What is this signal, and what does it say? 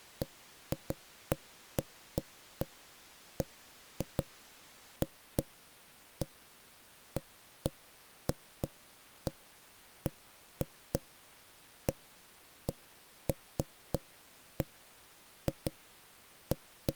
Irregular knocks on wood. There is no code.